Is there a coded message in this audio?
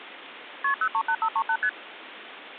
Yes: multi-frequency trunk signalling (R1, as on North American trunks) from 0.6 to 1.7 s, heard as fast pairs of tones, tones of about 70 ms, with phone line noise. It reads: KP 038538 ST